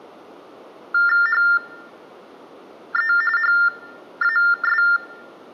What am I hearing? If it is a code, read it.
TTY/TDD text telephone tones (45.45 baud Baudot), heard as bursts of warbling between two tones, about 400 Hz shift, 1600 Hz centre. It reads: HE HAS